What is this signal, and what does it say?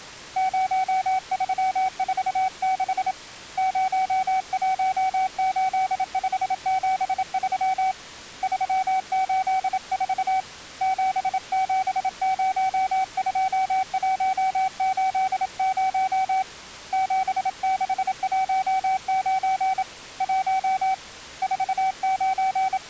Morse code, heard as a keyed tone, hand-sent with a paddle, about 27 wpm, 760 Hz. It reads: 0346 018573 384 7702180 7619 1 …